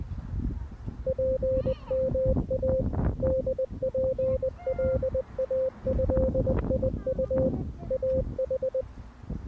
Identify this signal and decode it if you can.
Morse code (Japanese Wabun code), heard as a keyed tone, machine-sent, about 20 wpm, 520 Hz, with the noise of a residential street. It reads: ツヨイ ホツカイドウ イヌ